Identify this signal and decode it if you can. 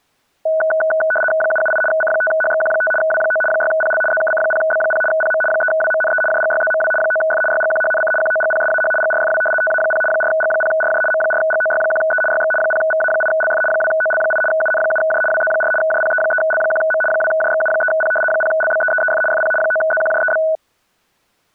RTTY (75 baud, 850 Hz shift), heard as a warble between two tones, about 1060 Hz centre. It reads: 778 C5HXQ5 W9 6PL ZKC0B0 PM 3WMNE JGYZMW 9F YGQHNC QOGPSAH GRFW TA0 4G0RJ M4GOY1E YX 0VA8LF 2OL8 UN7J WZ4 JPE3L1M 2JXU3P 0LBEEEF FP 9ZQJEB